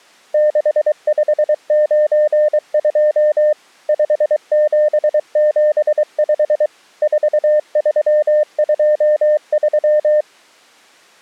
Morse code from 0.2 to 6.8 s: 6592 5775

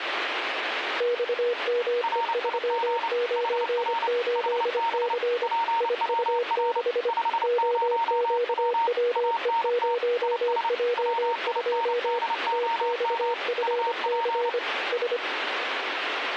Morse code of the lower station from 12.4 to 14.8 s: TXFC

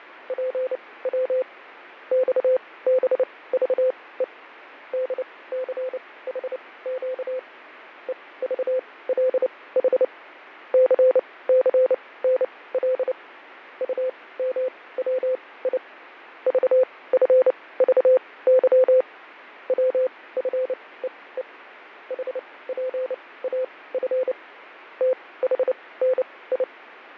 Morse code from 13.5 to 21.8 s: UMWI VFVY WFEE

